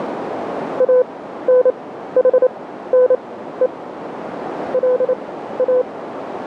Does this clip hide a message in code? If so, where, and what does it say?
Yes: Morse code (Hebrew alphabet) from 0.7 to 5.9 s, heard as a keyed tone, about 28 wpm, spaced as for 14 wpm, 500 Hz, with radio static and a narrow filter. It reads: אנחנו לא